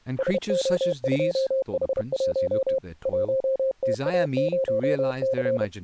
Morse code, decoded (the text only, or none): SO2H1 1TA0C